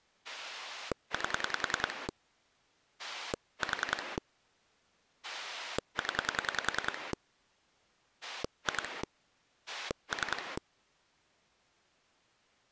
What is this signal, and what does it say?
Pulse dialling, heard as a rotary dial, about 10 pulses a second. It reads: 8 4 0 2 3